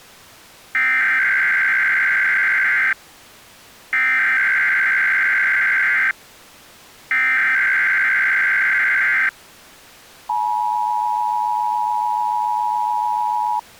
Emergency Alert System (SAME) tones (header bursts, then the 853 and 960 Hz attention tone), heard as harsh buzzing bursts, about 520.83 baud.